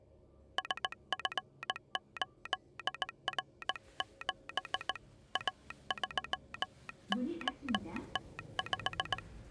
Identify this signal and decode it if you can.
Morse code, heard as a telegraph sounder, hand-sent with a straight key, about 18 wpm, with the noise inside a lift. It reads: SF8R7 A3OT5